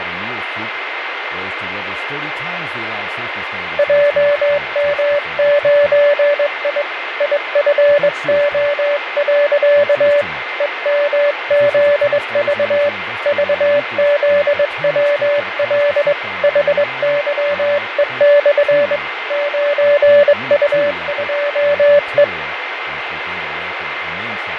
Morse code, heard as a keyed tone, hand-sent with a straight key, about 22 wpm, 580 Hz, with radio static, fading, a steady whistle near 2090 Hz and speech in English. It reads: JM9I IFO. EMZV VZWL HYE/ 9U2E